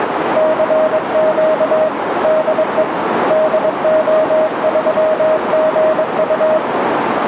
Morse code, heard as a keyed tone, hand-sent with a paddle, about 22 wpm, 630 Hz, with radio static and a narrow filter. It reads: CQ DE DO3GU